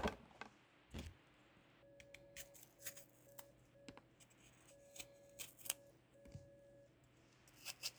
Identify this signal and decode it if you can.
Morse code, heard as a keyed tone, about 5 wpm, 560 Hz, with kitchen noise. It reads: BK